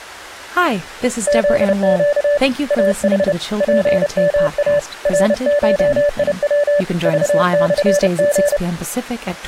Morse code (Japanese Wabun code), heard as a keyed tone, hand-sent with a paddle, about 30 wpm, 580 Hz, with speech in English. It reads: フネ イヌ ツヨイ ナゴヤ クモリ